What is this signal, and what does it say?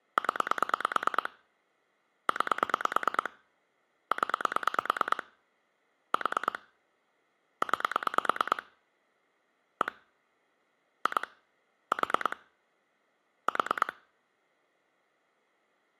Pulse dialling, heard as clicks on a phone line, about 9 pulses a second. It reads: 0 9 0 4 9 1 2 4 4